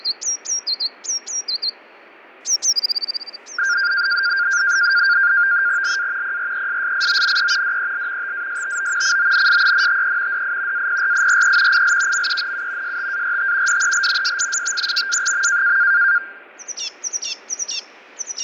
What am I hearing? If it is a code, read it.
NAVTEX (SITOR-B), 100 baud, 170 Hz shift, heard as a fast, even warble, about 1500 Hz centre, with fading. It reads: LA PRESSIONE DEL TASTO CONSENTE DI APRIRE IL MENU START DEL SISTEMA.